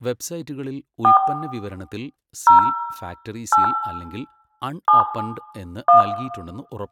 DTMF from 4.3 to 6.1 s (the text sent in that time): 7 1